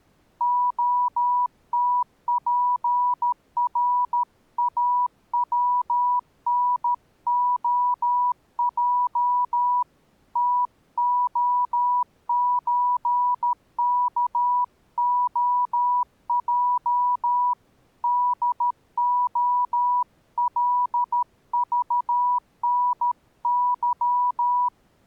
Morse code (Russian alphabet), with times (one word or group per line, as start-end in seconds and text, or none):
0.4-9.8 ОТПРАВНОЙ
10.4-17.5 ТОЧКОЙ
18.0-24.7 ДОЛЖНЫ